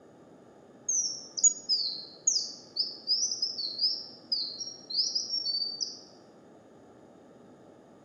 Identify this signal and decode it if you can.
Bird-like chirps, with room echo. There is no code.